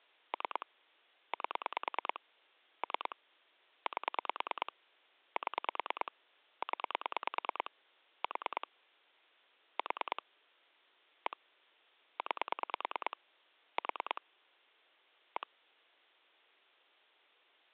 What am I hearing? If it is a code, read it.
Pulse dialling, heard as clicks on a phone line, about 9 pulses a second. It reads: 3 8 3 8 7 0 4 4 1 9 4 1